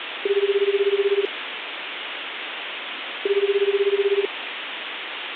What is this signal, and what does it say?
Telephone call progress tone (Japanese plan), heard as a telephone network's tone, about 380, 400, 420 Hz, 1 s on and 2 s off, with phone line noise. Ringback tone.